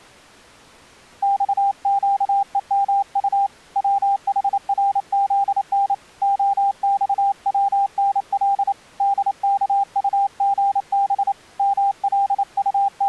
Morse code, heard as a keyed tone, hand-sent with a paddle, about 28 wpm, 800 Hz. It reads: XQEMU WHRZN OXWNL DKUGB …